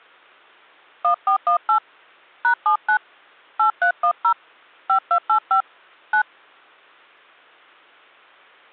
DTMF, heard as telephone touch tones, dialled by hand, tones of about 90 ms. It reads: 1418 #79 8310 5285 9